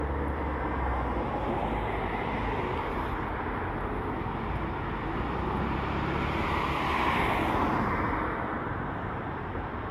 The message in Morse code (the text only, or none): none